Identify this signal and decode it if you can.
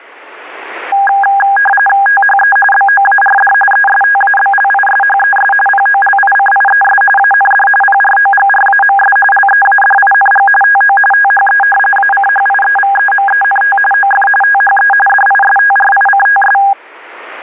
RTTY (45.45 baud, 850 Hz shift), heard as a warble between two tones, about 1220 Hz centre. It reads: THE BOARD ESTABLISHES POLICIES AND PROGRAMS LEADING TO THE ACHIEVEMENT OF THE DISTRICTS